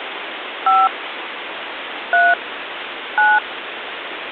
DTMF, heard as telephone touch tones, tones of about 210 ms, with phone line noise. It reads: 5 3 9